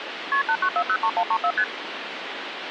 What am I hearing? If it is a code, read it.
Multi-frequency trunk signalling (R1, as on North American trunks), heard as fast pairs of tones, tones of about 70 ms, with phone line noise. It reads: KP 89403134 ST